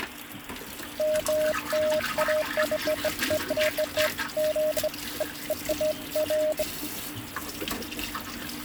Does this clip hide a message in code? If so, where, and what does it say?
No, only beeps of irregular length, with kitchen noise.